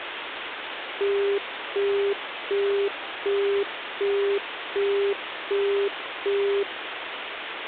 Telephone call progress tone (as in the UK, Australia and similar networks), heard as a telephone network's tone, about 400 Hz, 0.375 s on and 0.375 s off, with phone line noise. Busy tone.